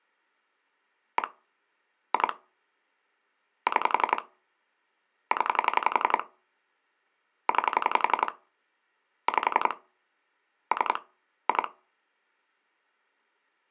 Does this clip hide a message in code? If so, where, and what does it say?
Yes: pulse dialling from 1.2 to 11.7 s, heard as clicks on a phone line, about 11 pulses a second. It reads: 1 2 6 0 9 5 3 2